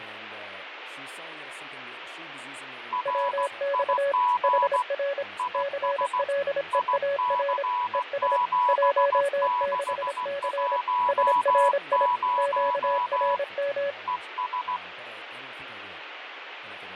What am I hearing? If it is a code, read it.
Morse code, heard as two keyed tones, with radio static, fading and speech in English. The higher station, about 16 wpm, 980 Hz: RIG IS IC7610 ES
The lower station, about 26 wpm, 560 Hz: WX HR CLEAR ES 16C SRI QRM